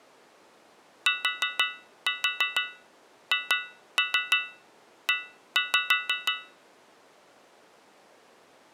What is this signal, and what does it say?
Tap code, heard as taps on a metal pipe, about 6 knocks a second. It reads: THE